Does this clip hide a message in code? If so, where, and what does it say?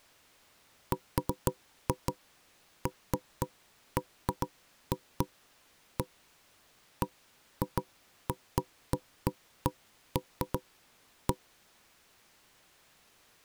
No, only irregular knocks on wood.